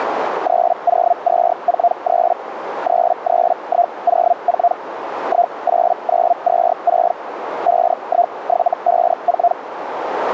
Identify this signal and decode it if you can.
Hellschreiber (Feld-Hell, 122.5 baud), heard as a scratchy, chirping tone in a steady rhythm, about 700 Hz, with radio static and a narrow filter. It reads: 30243 33104 18926 51754